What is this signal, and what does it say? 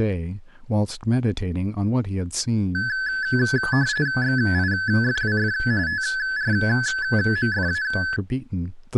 RTTY (45.45 baud, 170 Hz shift), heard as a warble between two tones, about 1600 Hz centre, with speech in English. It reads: XIFWF TRMFA